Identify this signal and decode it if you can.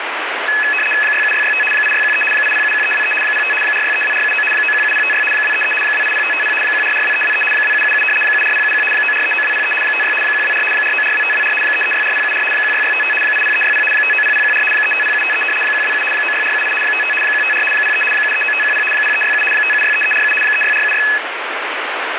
RTTY (75 baud, 850 Hz shift), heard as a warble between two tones, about 2150 Hz centre, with radio static. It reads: 67665 8613 8071323 05 4632479 917056 233 280550 1442323 2777 74071 9439203 56 124 4942524 3364074 16655 80360 590014 350753 127 96478 55 154 03 739510 0367 5763347 36476